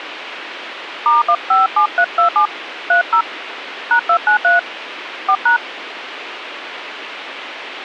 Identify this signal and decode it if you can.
DTMF, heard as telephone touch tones, dialled by hand, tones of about 120 ms, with radio hiss. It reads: *157327 30 #293 4#